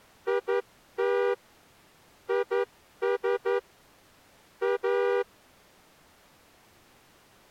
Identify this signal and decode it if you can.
Morse code, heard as a horn, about 11 wpm. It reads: IT IS A